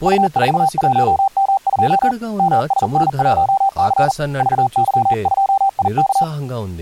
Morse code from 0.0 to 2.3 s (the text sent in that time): U41M2